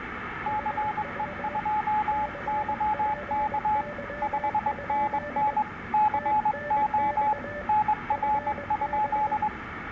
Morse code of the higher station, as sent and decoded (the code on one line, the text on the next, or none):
-.-. . ..--- -.-- -.- / ..... -. -. / -.-. --- / -. .-. ..--..
CE2YK 5NN CO NR?